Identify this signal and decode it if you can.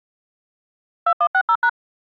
DTMF, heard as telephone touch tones, dialled by machine, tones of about 70 ms. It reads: 2160#